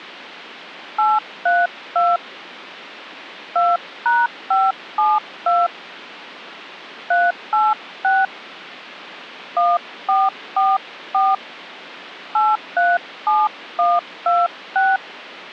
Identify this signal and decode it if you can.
DTMF, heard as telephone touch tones, dialled by hand, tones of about 210 ms. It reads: 832 2#572 386 1444 837126